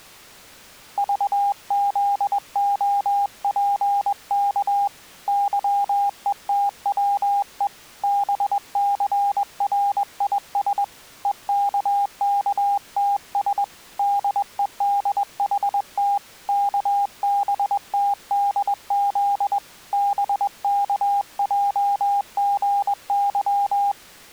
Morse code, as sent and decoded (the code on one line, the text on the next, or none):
...- --.. --- .--. -.- / -.-- . - .-- . / -... -.-. .-. .. ... / . -.- -.- - ... / -.. . -.. .... - / -.- -... - -.. --.. / -... -.- .--- --. -.--
VZOPK YETWE BCRIS EKKTS DEDHT KBTDZ BKJGY